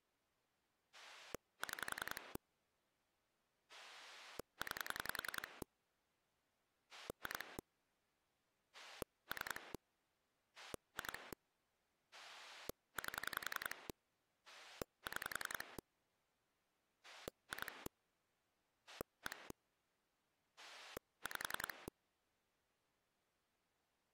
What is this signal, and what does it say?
Pulse dialling, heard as a rotary dial, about 10 pulses a second. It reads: 6 9 2 3 2 8 6 2 1 5